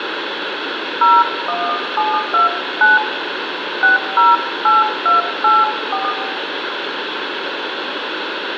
DTMF, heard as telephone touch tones, dialled by hand, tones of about 170 ms, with phone line noise and room echo. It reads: 01729 608284